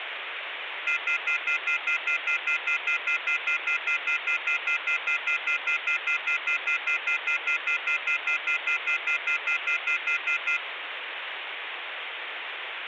Telephone call progress tone (North American plan), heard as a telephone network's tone, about 1400, 2050, 2450, 2600 Hz, 0.1 s on and 0.1 s off, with phone line noise. Off-hook warning tone.